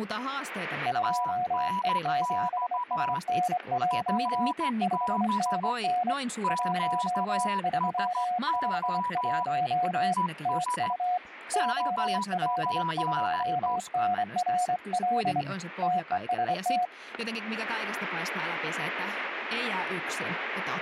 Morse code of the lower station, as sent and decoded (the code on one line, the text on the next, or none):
..--- . --... ... -. .--- / ..... -. -. / .---- ...-- ..... .---- / - ..- / --- .-.. ..--- -. .-. .-.. / - . ... -
2E7SNJ 5NN 1351 TU OL2NRL TEST